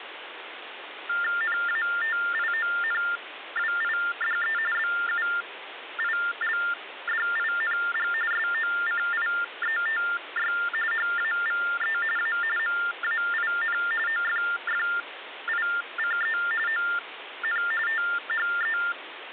TTY/TDD text telephone tones (45.45 baud Baudot), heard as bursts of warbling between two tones, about 400 Hz shift, 1600 Hz centre, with phone line noise. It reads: NATIONWIDE BUILDING SOCIETY HAVE A MAIN OFFICE ON THE